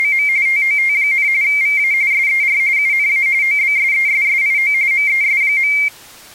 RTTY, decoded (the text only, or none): … TOT, VA SER UNA OBSESSIO MES.